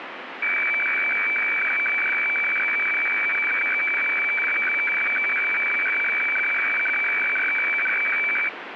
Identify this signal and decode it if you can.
Weather fax (radiofax), 120 lines a minute, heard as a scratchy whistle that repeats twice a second, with radio static.